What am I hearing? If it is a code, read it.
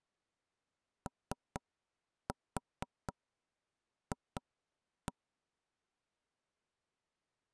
Tap code, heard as knocks on wood, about 4 knocks a second. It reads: OF